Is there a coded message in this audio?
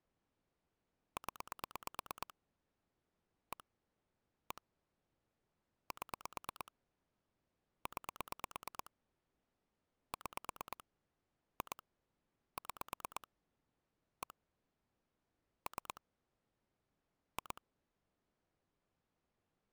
Yes: pulse dialling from 1.2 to 17.6 s, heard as clicks on a phone line, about 8 pulses a second. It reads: 0 1 1 7 9 6 2 6 1 3 2